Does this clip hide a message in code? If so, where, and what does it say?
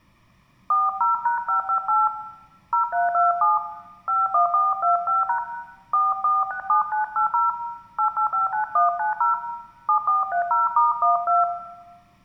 Yes: DTMF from 0.7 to 11.4 s, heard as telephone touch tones, dialled by hand, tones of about 140 ms, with room echo. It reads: 40#558 0327 51425# 4467980 8859190 7430*12